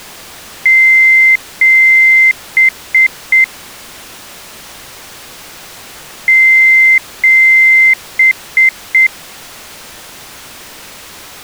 Beep code, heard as beeps, played twice, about 2100 Hz. 2 long, 3 short.